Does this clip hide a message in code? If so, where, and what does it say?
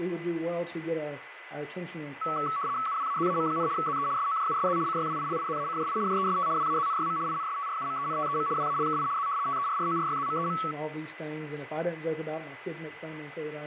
Yes: RTTY (75 baud, 170 Hz shift) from 2.2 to 10.7 s, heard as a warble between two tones, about 1220 Hz centre, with radio static and a steady whistle near 2010 Hz. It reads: UWAZAM, ZE SOJUSZ CYWILIZACJI JEST WAZNYM INSTRUMENTEM WALKI Z TERRORYZMEM